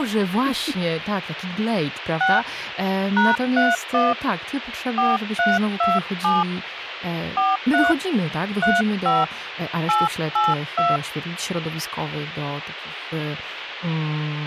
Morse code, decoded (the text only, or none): none